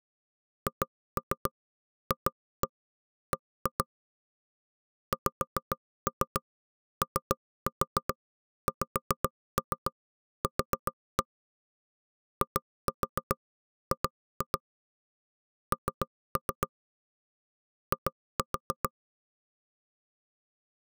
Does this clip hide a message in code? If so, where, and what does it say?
Yes: tap code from 0.7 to 18.9 s, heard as knocks on wood, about 7 knocks a second. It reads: HFB XOXQ IG N I